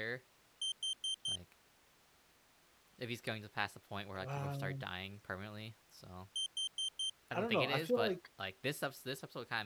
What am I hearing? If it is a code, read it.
Alarm pattern, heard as an alarm's beeps, played twice, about 3150 Hz, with speech in English. Temporal four. Carbon monoxide.